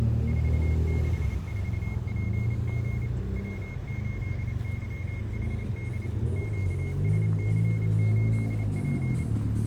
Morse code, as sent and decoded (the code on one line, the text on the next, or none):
....- -.... ....- .--. --. / .-- ---.. -.-- .... -.. / --.- ... -.-. ---.. .--.
464PG W8YHD QSC8P